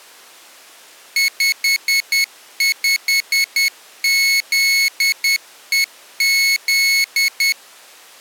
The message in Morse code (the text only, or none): 55ZEZ